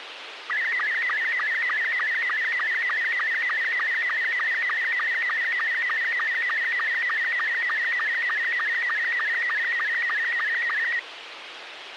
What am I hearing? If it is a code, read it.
SSTV (slow-scan television), Robot 72, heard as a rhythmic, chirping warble, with radio hiss.